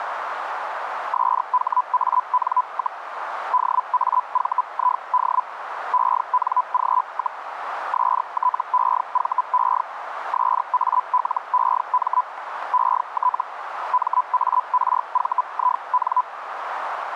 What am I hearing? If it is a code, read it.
Hellschreiber (Feld-Hell, 122.5 baud), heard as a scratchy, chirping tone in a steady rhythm, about 1000 Hz, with radio static and a narrow filter. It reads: SHAN, DAVID ENG, STEVE SALEM ET MARVIN